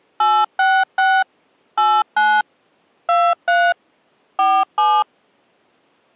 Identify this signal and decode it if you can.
DTMF, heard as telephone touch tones, dialled by machine, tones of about 250 ms. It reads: 866 89 23 47